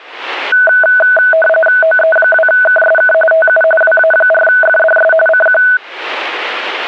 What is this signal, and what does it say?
RTTY (45.45 baud, 850 Hz shift), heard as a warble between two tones, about 1070 Hz centre. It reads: OE2KSK TU WA4FDS CQ